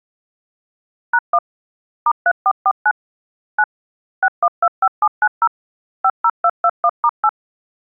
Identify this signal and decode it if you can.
DTMF, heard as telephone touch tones, dialled by machine, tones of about 60 ms. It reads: #1 *3449 9 6125790 50221*8